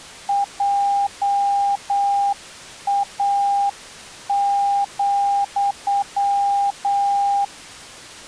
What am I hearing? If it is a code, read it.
Morse code, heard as a keyed tone, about 8 wpm, 800 Hz. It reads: JA,